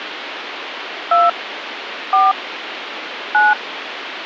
DTMF, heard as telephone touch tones, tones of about 190 ms, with phone line noise. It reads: 2 4 9